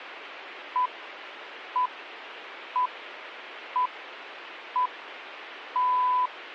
Radio time signal (six pips, as the Greenwich Time Signal), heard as pips.